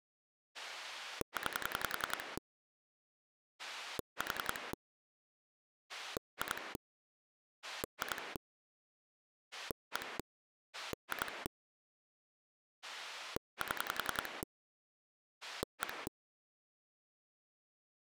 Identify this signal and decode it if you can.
Pulse dialling, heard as a rotary dial, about 10 pulses a second. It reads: 9 4 2 2 1 2 7 1